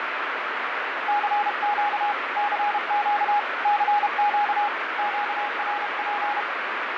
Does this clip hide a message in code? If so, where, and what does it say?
Yes: Morse code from 1.0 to 6.5 s, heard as a keyed tone, hand-sent with a paddle, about 32 wpm, 830 Hz, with heavy radio static and fading. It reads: CQ CQ CQ QRP